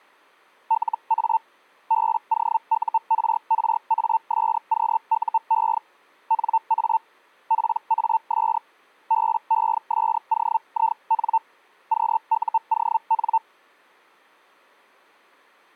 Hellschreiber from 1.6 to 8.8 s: BOURRASQUE NA PAS

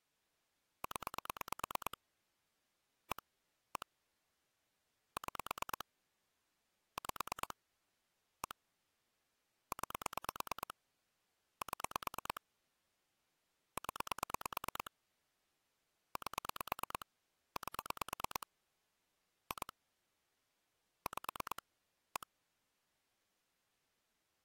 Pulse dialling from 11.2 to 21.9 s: 7 0 8 8 2 5

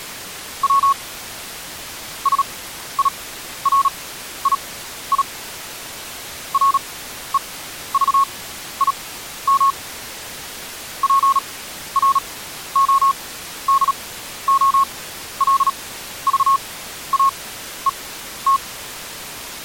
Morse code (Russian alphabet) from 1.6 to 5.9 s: СИРИИ

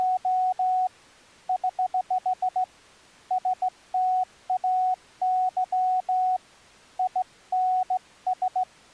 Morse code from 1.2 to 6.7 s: <HH> STAY

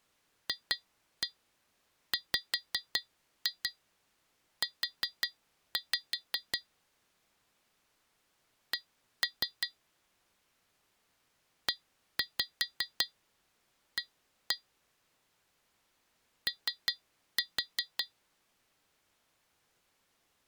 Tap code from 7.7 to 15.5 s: C EA

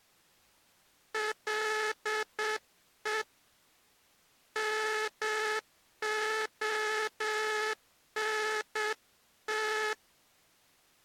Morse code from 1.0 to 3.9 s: LE

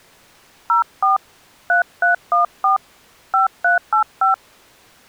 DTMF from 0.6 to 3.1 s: 04 3314

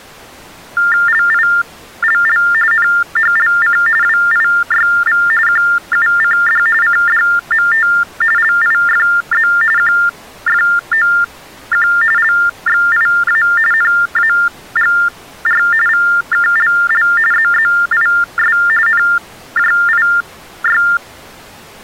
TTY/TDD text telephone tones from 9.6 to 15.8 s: QFOQ LXIA NAGR

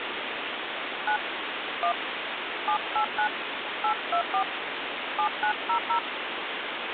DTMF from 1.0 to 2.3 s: 9 1

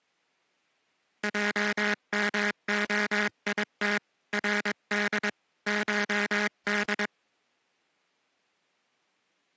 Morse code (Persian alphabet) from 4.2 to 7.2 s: رد شد

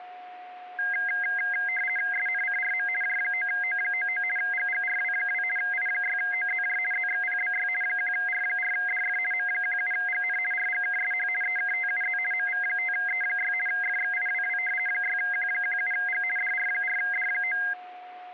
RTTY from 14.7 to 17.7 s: 6Q17G DR4D9

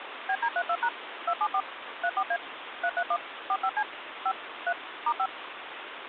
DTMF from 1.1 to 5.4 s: 274 34A 331 45C 5 3 *5

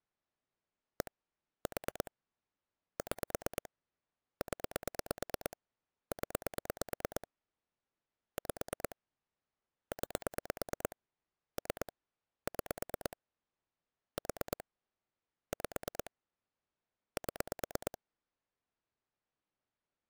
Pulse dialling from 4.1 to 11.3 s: 0 0 5 9

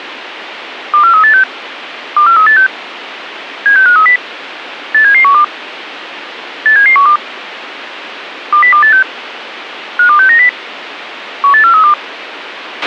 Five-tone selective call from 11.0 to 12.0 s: 18432

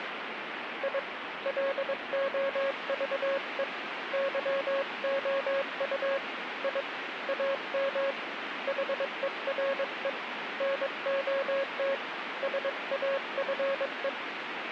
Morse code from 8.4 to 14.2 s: HERE NOT SAFE

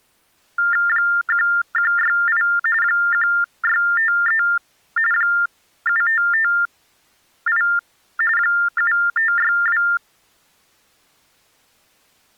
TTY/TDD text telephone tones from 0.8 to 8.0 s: 1168 1653 7558

